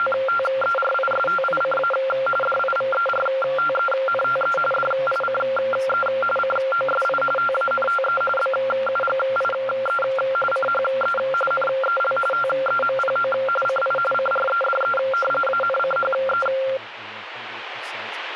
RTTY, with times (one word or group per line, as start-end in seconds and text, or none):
0.0-1.9 …
2.4-4.6 DIVERTENTE
4.7-6.1 DICE
6.4-7.2 COSI
7.4-8.2 TANTE
8.4-10.0 BUGIE
10.5-11.2 CHE
11.5-12.2 NEL
12.3-13.3 TEMPO
13.7-14.0 CI
14.1-15.0 CREDE
15.5-16.5 ANCHE